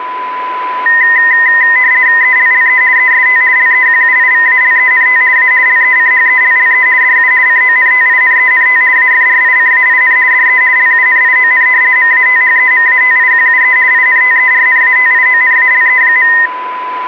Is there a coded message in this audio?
Yes: RTTY (50 baud, 170 Hz shift) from 0.9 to 16.5 s, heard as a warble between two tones, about 1950 Hz centre, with a steady whistle near 1000 Hz. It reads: ELLE EST LEQUIVALENT A LECHELLE DU CONTINENT AFRICAIN DE LUNION MATHEMATIQUE INTERNATIONALE.